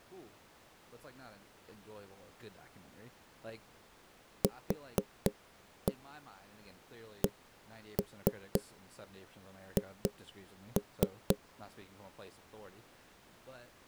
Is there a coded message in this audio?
Yes: tap code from 4.4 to 11.4 s, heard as knocks on wood, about 4 knocks a second, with speech in English. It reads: QCH